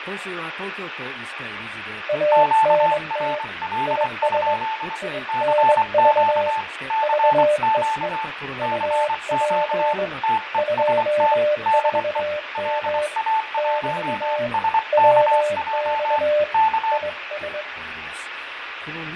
Morse code, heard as two keyed tones, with radio static, fading and speech in Japanese. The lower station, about 21 wpm, 600 Hz: ANT IS INV VEE UP 24M <BT> WX IS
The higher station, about 24 wpm, 880 Hz: QRL? CQ CQ CQ TEST DE LA1SKJ K